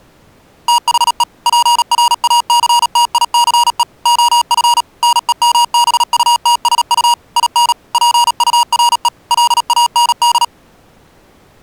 Morse code, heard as electronic beeps, machine-sent, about 37 wpm, 950 Hz. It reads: THE PRACTICE OF NEMBUTSU IN PURE LAND